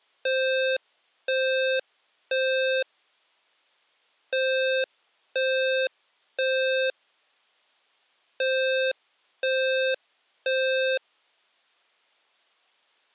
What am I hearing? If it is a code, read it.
Alarm pattern, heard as an alarm's beeps, played three times, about 520 Hz. Temporal three. Smoke or fire, evacuate.